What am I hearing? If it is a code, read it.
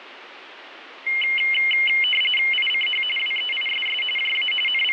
RTTY (45.45 baud, 850 Hz shift), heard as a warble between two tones, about 2550 Hz centre, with radio static. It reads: ICH WEISS JA …